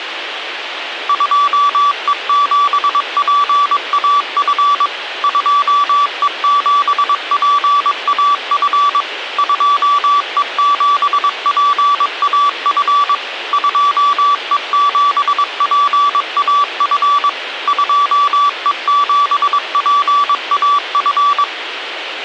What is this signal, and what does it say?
Morse code, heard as a keyed tone, machine-sent, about 22 wpm, 1150 Hz, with radio hiss. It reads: 2E7PAF 2E7PAF 2E7PAF 2E7PAF 2E7PAF